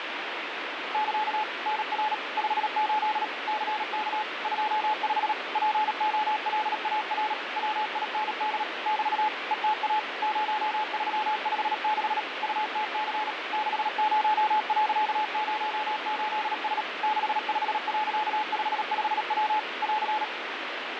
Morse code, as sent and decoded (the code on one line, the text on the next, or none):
-.-.- / -. .-. / ..... ---.. / -.-. -.- / ..--- ..... / .--. --- .-.. .- .-. / .-- .. -. -.. / -...- / . - .- / ----- ...-- ..... -.... / ..- - -.-. / -.... ----- .-.-.- ----- ---.. ... / -.... ..... .-.-.- ..... ..... .-- / .-.-.
<KA> NR 58 CK 25 POLAR WIND <BT> ETA 0356 UTC 60.08S 65.55W <AR>